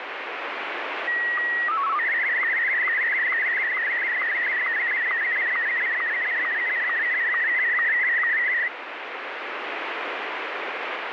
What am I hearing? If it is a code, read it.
SSTV (slow-scan television), Martin M1, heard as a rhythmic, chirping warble, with radio static.